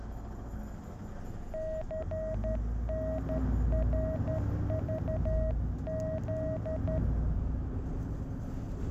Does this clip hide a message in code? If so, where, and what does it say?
Yes: Morse code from 1.5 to 7.0 s, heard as a keyed tone, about 12 wpm, 640 Hz, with the noise inside a bus. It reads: CNRVZ